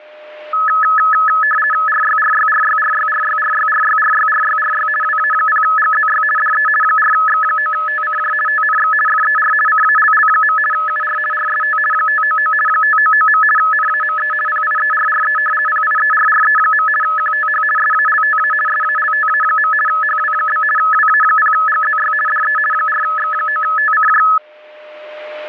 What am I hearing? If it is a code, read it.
RTTY (50 baud, 450 Hz shift), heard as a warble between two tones, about 1500 Hz centre, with a steady whistle near 610 Hz. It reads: RYRYRYRYRYRYRYRYRYRY WA0GZY DE 4X9TCJ TNX FER CALL. UR RST 599 599. NAME PIERRE PIERRE. QTH SALTA SALTA. HW? WA0GZY DE 4X9TCJ